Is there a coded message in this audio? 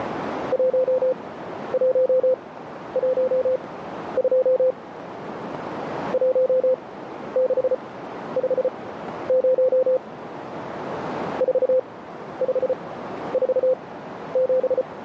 Yes: Morse code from 0.5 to 14.9 s, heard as a keyed tone, machine-sent, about 34 wpm, spaced as for 12 wpm, 520 Hz, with radio static and a narrow filter. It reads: 1112 1650 4547